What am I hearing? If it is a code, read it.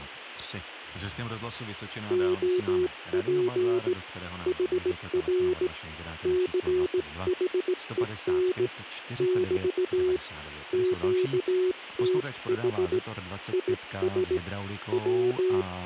Morse code, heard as a keyed tone, hand-sent with a straight key, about 17 wpm, 370 Hz, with speech in Czech. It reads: OP HR CHEN <BT> QTH IS …